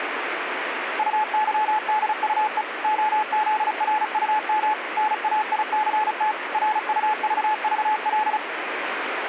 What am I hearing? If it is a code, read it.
Morse code, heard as a keyed tone, machine-sent, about 35 wpm, 860 Hz, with radio static. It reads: UYDUE OZRUM NAICT RUVVL